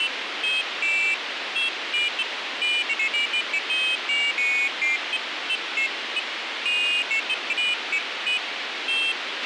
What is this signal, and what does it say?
Pairs of high tones at irregular times, with radio hiss and a squelch burst at the end. There is no code.